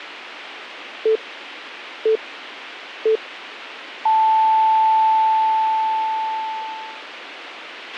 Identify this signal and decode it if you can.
Radio time signal (three low pips and a long one an octave up, as on NHK), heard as pips, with a squelch burst at the end.